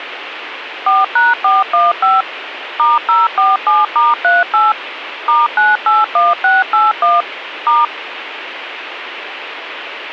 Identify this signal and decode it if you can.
DTMF, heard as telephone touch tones, dialled by machine, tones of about 180 ms, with radio hiss. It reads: 4#415 *047*38 *981681 *